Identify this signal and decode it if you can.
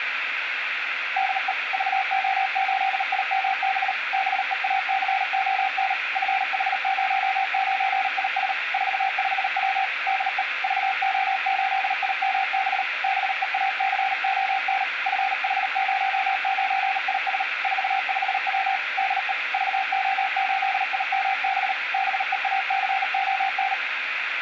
Morse code, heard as a keyed tone, machine-sent, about 38 wpm, 770 Hz, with radio hiss and room echo. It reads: DE VO8IMB BEACON FH09IS 45W DE VO8IMB BEACON FH09IS 45W DE VO8IMB BEACON